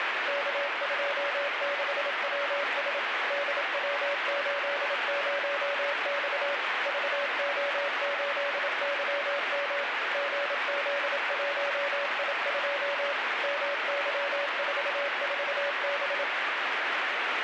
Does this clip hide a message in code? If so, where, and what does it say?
Yes: Morse code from 0.2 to 16.3 s, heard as a keyed tone, machine-sent, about 27 wpm, 570 Hz, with heavy radio static. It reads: K26WS DW80X VO8YM GZ1I2 MY44B